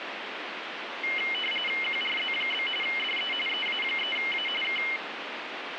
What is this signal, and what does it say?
RTTY (45.45 baud, 850 Hz shift), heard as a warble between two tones, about 2550 Hz centre, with radio static. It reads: QRZ? DE EA3A K